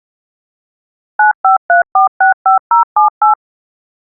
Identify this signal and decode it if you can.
DTMF, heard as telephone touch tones, dialled by machine, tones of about 120 ms. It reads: 953465078